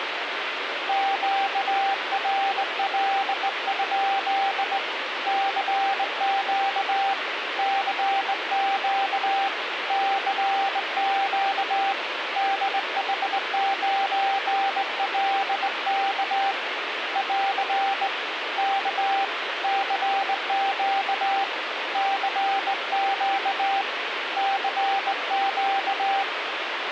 Morse code, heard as a keyed tone, hand-sent with a straight key, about 19 wpm, 780 Hz, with radio static. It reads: QRL? CQ CQ CQ DH9LK <AR> K CQ CQ CQ